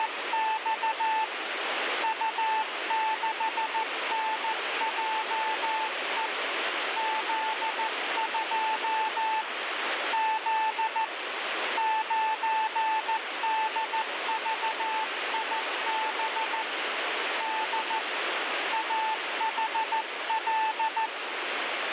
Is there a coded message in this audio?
Yes: Morse code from 0.0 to 21.1 s, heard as a keyed tone, hand-sent with a paddle, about 14 wpm, 880 Hz, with radio static. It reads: … U6NJE Z2 Z 9DVIB D AHL